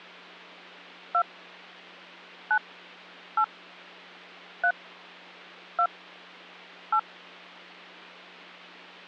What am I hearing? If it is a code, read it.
DTMF, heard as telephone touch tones, dialled by hand, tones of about 70 ms, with hum. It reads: 2 9 8 3 2 8